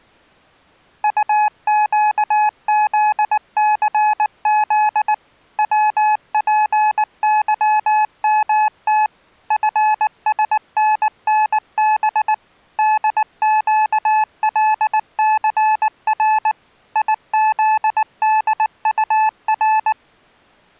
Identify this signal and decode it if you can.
Morse code, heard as a keyed tone, machine-sent, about 19 wpm, 860 Hz. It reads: UQZCZ WPYMT FSNNB DQLCR IZDUR